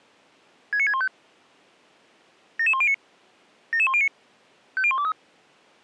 Five-tone selective call (ZVEI), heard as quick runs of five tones, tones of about 70 ms. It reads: 69615 77109 77109 50123